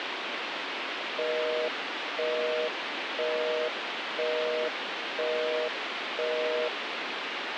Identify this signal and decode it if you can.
Telephone call progress tone (North American plan), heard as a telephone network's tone, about 480, 620 Hz, 0.5 s on and 0.5 s off, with phone line noise. Busy tone.